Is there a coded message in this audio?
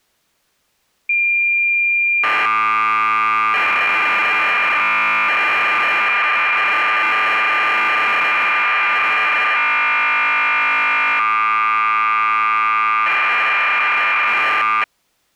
Yes: cassette data (Kansas City type), 1200 baud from 1.1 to 14.8 s, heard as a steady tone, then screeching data.